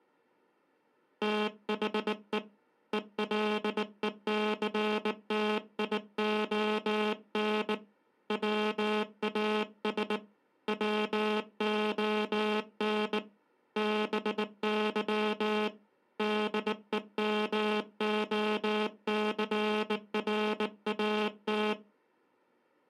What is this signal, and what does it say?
Morse code, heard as a buzzer, hand-sent with a bug key, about 19 wpm. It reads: THE ELECTION WAS WON BY DEMOCRAT